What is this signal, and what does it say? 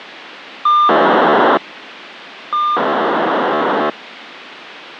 POCSAG pager data (2400 baud), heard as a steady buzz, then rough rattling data, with radio hiss.